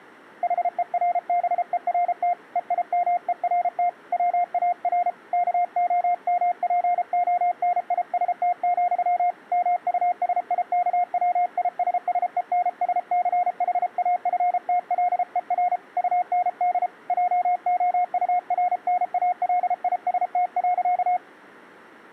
Morse code, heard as a keyed tone, hand-sent with a paddle, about 33 wpm, 710 Hz. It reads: HERBERT EIMERT WAR KOMPONIST, MUSIKWISSENSCHAFTLER UND JOURNALIST.